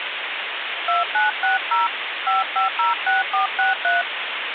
DTMF, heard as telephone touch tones, dialled by hand, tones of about 150 ms, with phone line noise. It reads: 2960 5506463